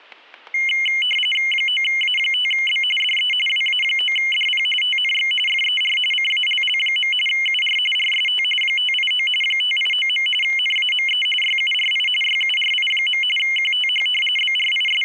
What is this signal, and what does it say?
RTTY (45.45 baud, 850 Hz shift), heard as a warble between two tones, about 2550 Hz centre, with static crashes. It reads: 9A5B DE WA9DP TNX FER CALL. UR RST 589 589. NAME YURI YURI. QTH …